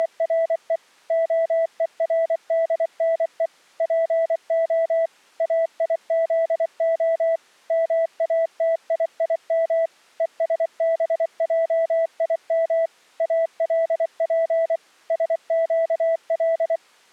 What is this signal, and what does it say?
Morse code (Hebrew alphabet), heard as a keyed tone, machine-sent, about 24 wpm, 660 Hz. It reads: … הורדנו פה איזה מאתיים ושבעים אלף שקל